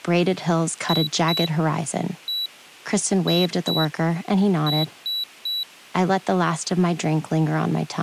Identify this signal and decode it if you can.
Beep code, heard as a piezo beeper, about 3950 Hz, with speech in English. 2-1-2-3. In Phoenix BIOS tables: ROM copyright notice check failure.